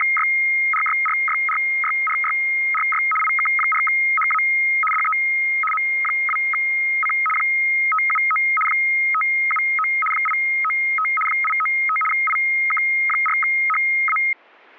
RTTY (75 baud, 850 Hz shift), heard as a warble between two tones, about 1700 Hz centre. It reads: … IK4HA DE M2C 579 579 895 895 IK4HA